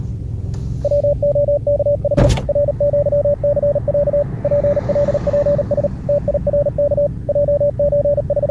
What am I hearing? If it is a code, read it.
Morse code (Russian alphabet), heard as a keyed tone, machine-sent, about 38 wpm, 580 Hz, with the noise inside a car. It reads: ВОКХ РЪЦЯ ПЛПС ТИРК …